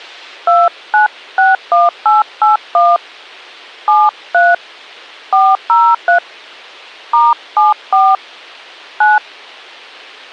DTMF, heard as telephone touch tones, dialled by hand, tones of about 190 ms. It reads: 2961881 73 403 *74 9